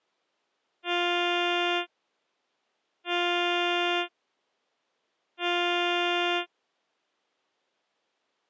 Ship horn signal, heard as a ship's horn, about 350 Hz. 3 short. At sea: I am operating astern propulsion.